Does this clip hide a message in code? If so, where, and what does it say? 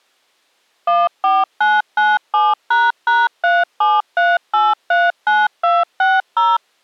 Yes: DTMF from 0.9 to 6.6 s, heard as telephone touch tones, dialled by machine, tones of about 200 ms. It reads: 14997##373839260